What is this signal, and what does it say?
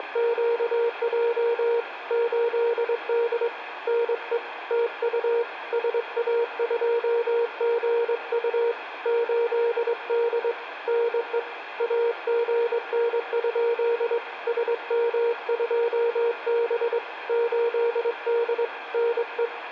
Morse code, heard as a keyed tone, hand-sent with a straight key, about 22 wpm, 470 Hz, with room echo. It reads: … 8D NE TU SA2GU 8D NE AGN? SM2B 8D NE